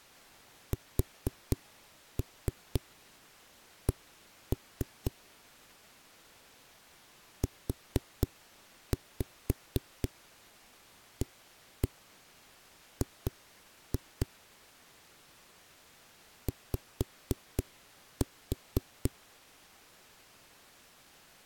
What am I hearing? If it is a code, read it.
Tap code, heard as knocks on a wall, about 4 knocks a second. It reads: SC UAG Y